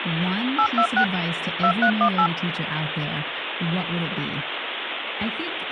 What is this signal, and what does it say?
DTMF, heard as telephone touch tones, dialled by hand, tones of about 80 ms, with phone line noise and speech in English. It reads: 826 2318